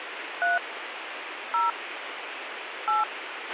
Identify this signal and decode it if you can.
DTMF, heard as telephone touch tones, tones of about 160 ms, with radio hiss and a squelch burst at the end. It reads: 3 0 8